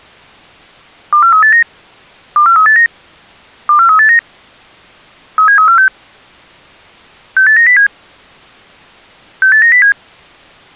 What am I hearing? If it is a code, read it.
Five-tone selective call (CCIR), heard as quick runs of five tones, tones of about 100 ms. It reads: 24389 24389 24389 37346 68907 68907